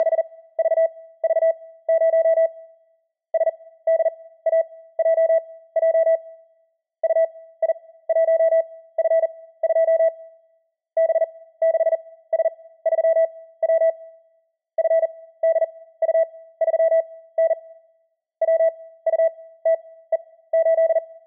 Morse code, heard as a keyed tone, machine-sent, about 40 wpm, spaced as for 18 wpm, 650 Hz. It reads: … SDAJJ UI1F2 B6S3W FDU3N WUTE8